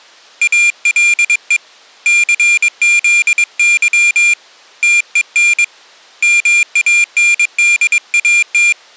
Morse code, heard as a high beeper, hand-sent with a paddle, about 22 wpm, 2400 Hz. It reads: ALE CZY TEN MANDAT